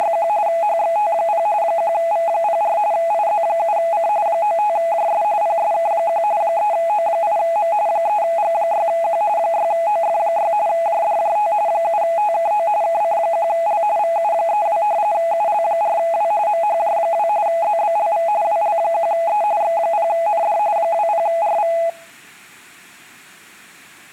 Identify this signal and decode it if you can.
RTTY (45.45 baud, 170 Hz shift), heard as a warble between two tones, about 750 Hz centre. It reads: … HXT0 1V04 IZ7C 95JS PSK1 3O8M 3G6Q 6OF6 JDJT 7TKO KC1L VU32 UL4W MHJ2 ZBLV WL1E X0ND 20RV